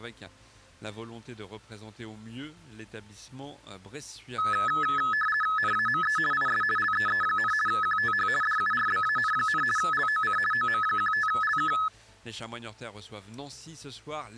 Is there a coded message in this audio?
Yes: RTTY (50 baud, 450 Hz shift) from 4.4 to 11.9 s, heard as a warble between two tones, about 1500 Hz centre. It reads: NAME IS LEE, QTH DURBAN, LOC OM15LK